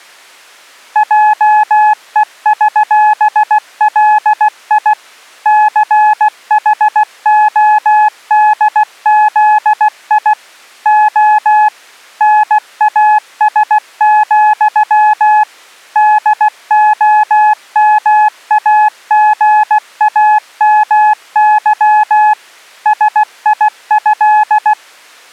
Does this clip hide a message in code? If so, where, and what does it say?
Yes: Morse code (with Polish letters) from 0.9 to 24.8 s, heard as a keyed tone, machine-sent, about 16 wpm, 850 Hz. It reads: JEŚLI CHODZI O NAS, DOMAGAMY SIĘ